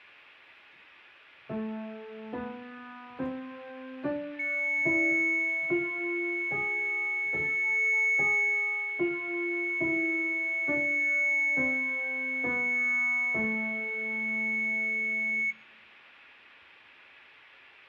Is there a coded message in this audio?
No, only a steady tone, with fading.